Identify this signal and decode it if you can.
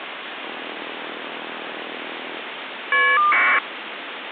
Caller ID data burst, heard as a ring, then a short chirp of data, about 1200 baud, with phone line noise.